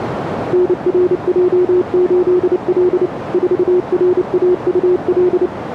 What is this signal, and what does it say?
Morse code, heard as a keyed tone, machine-sent, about 29 wpm, 360 Hz, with radio static and a narrow filter. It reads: NRJ8L 4RAUL